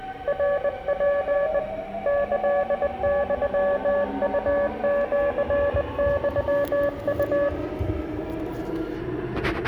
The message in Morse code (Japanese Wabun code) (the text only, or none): ナツ キユウシユウ